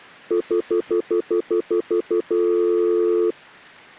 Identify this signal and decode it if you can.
Telephone call progress tone (North American plan), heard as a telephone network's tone, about 350, 440 Hz, 0.1 s on and 0.1 s off. Stutter dial tone.